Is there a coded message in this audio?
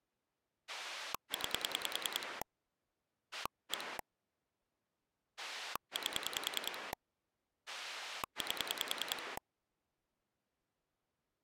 Yes: pulse dialling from 0.7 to 9.4 s, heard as a rotary dial, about 10 pulses a second. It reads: 9 1 8 8